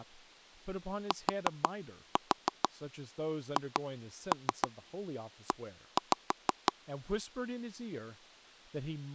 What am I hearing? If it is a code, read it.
Tap code, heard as taps on a table, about 6 knocks a second, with speech in English. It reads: THE